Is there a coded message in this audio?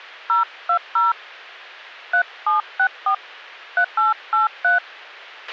Yes: DTMF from 0.3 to 4.8 s, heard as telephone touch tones, dialled by hand, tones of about 120 ms, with a squelch burst at the end. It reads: 020 3764 3883